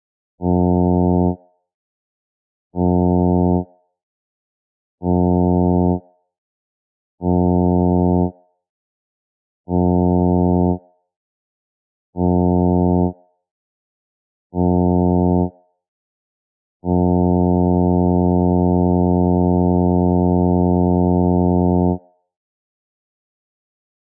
Ship horn signal, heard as a ship's horn, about 90 Hz, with room echo. 7 short, 1 long. At sea: general emergency alarm.